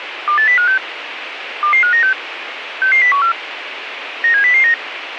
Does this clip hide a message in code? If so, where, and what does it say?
Yes: five-tone selective call (CCIR) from 0.3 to 4.7 s, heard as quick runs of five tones, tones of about 100 ms, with radio hiss. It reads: 28056 22596 66014 97009